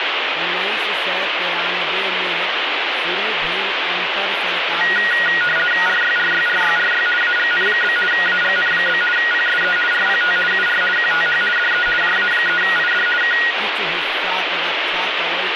RTTY (50 baud, 450 Hz shift), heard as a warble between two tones, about 1650 Hz centre, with radio static and speech in Maithili. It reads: RYRYRYRY AGN? AGN? PSE RPT UR QTH DE JA3ID K